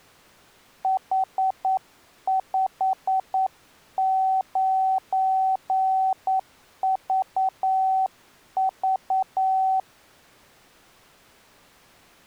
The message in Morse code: H59VV

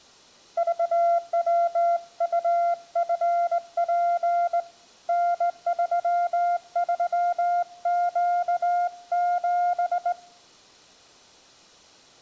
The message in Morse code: VWUFP N33Q7

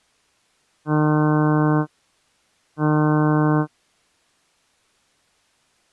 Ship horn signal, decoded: 2 short

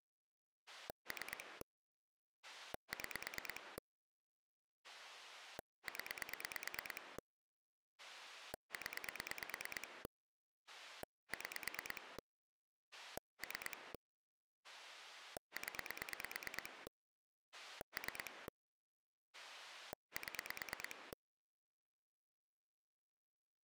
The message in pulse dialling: 3 6 0 0 6 3 0 3 7

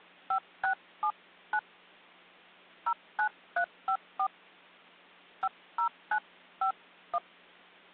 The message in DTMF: 5679 09354 50951

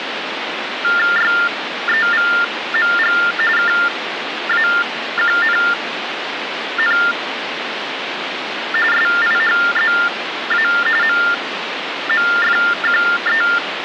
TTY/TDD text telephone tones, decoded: YEVMG KAQNN SIHZA MMFQE

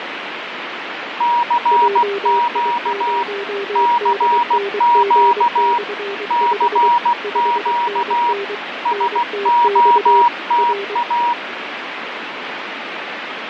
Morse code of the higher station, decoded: CQ CQ CQ SOTA

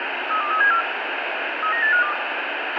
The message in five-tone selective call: 32374 39852

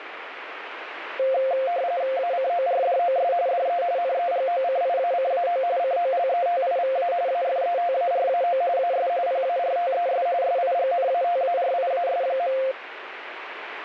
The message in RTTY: ACORDOS DE NEGOCIACAO COLETIVA AFETARAO AS PARTES SIGNATARIAS.

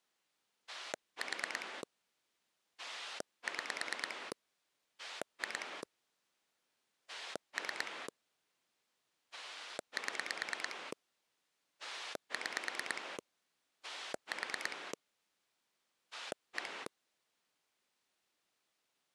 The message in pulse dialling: 4 6 2 3 7 6 4 1

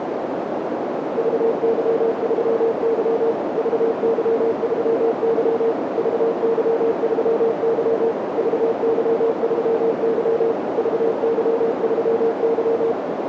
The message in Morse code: VY3Y VY3Y VY3Y VY3Y VY3Y

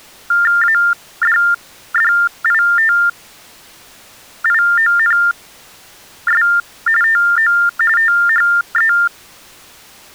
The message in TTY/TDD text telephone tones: ADDITIONS TO THE

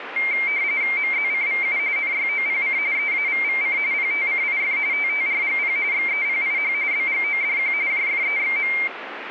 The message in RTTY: MZCVU NYOPC EAVVC PTCIF TTRGP XEPIH BGODQ JFEXM

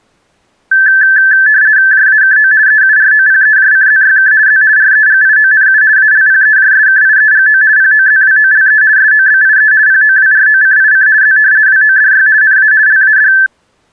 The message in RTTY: JAKO EUROPEJCZYK Z REGIONU ALPEJSKIEGO POZWOLE SOBIE POWROCIC Z WODY NA LAD

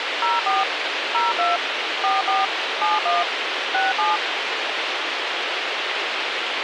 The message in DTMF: 04 02 44 71 67

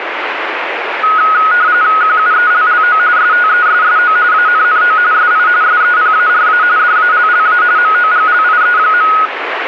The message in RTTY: QUELLO STESSO ANNO SI SEPARA DALLA MOGLIE.

